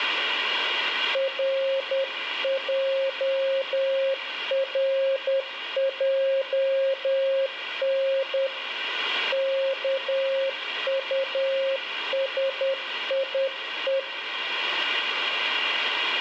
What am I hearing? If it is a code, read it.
Morse code, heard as a keyed tone, hand-sent with a paddle, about 10 wpm, 540 Hz, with radio static and room echo. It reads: RJRJN KUSIE